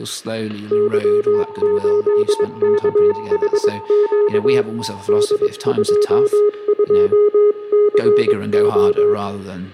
Morse code, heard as two keyed tones, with static crashes, room echo and speech in English. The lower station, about 22 wpm, 420 Hz: Y8KHQ D22CO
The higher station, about 23 wpm, 890 Hz: 6ETSQD T